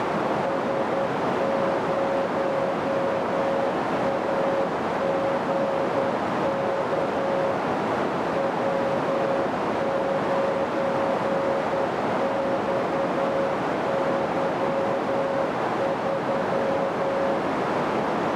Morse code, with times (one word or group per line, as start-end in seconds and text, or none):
0.4-7.5 S0AGK
8.4-17.4 W9XY3